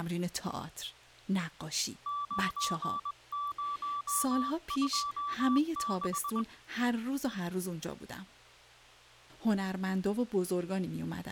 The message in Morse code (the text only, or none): 9026